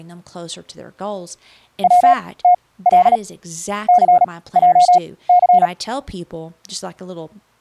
Morse code (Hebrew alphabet), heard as a keyed tone, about 37 wpm, spaced as for 20 wpm, 720 Hz, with speech in English. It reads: צתל סעס